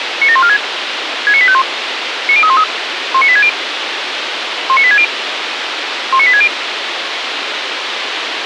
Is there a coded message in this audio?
Yes: five-tone selective call (ZVEI) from 0.2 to 6.5 s, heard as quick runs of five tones, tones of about 70 ms, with radio hiss. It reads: 97146 69851 90313 19860 19860 19860